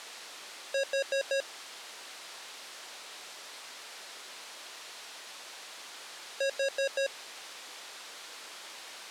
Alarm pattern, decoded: temporal four

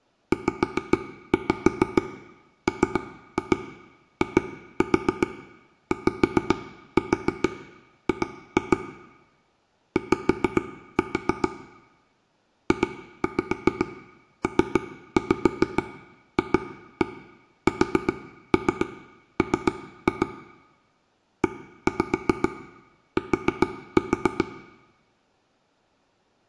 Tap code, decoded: ZMIYG Y JPFSM ET

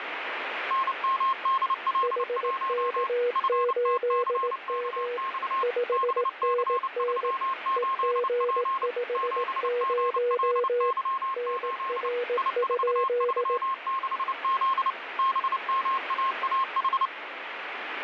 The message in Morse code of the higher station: NMDL1 FTCKX BC38P 7GLY8 I436Z BMAAH

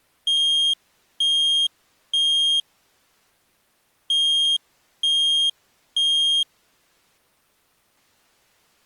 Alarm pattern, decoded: temporal three

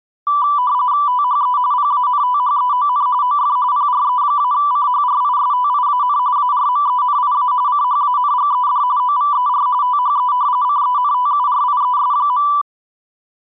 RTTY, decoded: THE PANTHEON OF PRE-CHRISTIAN ARMENIA CHANGED OVER THE CENTURIES.

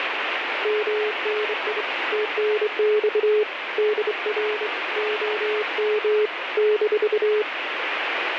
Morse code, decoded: MNI TNX DR OM -

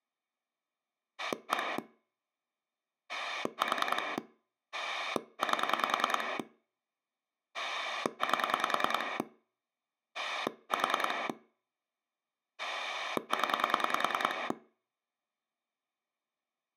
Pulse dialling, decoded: 1 4 8 8 4 0

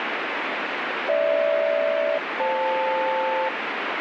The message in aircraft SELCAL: GH-FL

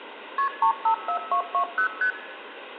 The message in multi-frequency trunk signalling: KP 354220 ST

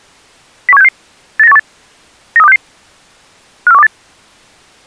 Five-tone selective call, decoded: 01766 89818 93266 54128

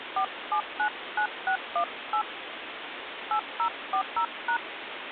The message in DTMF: 4799618 8040#

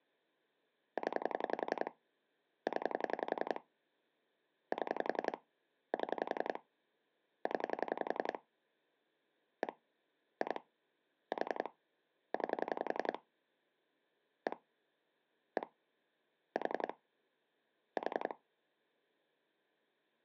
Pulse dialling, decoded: 0 0 7 7 0 1 2 4 9 1 1 4 4

